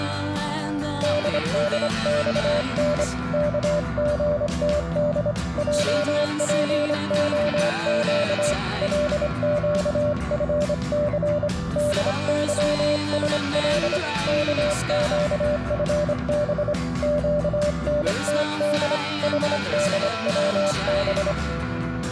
Morse code, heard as a keyed tone, hand-sent with a straight key, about 25 wpm, 590 Hz. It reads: DDXN KGTD JPOQ LQFC DYSL KQFB QNTD HDWB